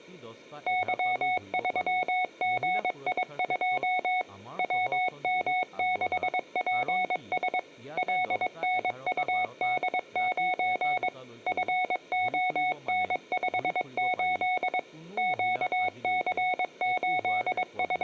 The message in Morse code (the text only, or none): Y3GI2 WM6PS LNUD9 FON58 …